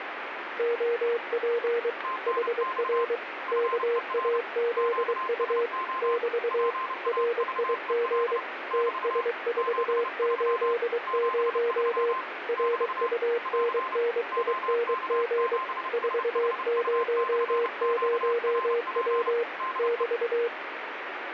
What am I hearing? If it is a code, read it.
Morse code, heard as two keyed tones, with radio static. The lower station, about 23 wpm, 470 Hz: OP HR KAZU <BT> RIG TS480 RUNNING 400W <BT>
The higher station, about 30 wpm, 1040 Hz: TNX FER QSO PAVEL <BT> 73 73 <BT> <AR> OK7SHU/QRP DE